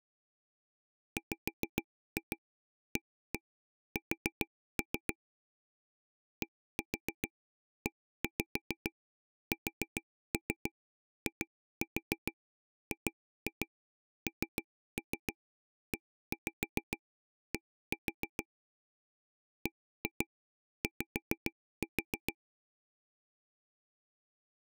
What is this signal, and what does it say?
Tap code, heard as taps on a table, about 6 knocks a second. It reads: WAS DESIGNED BY